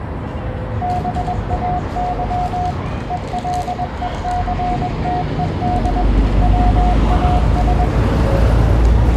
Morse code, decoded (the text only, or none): BAY ELECTED WAS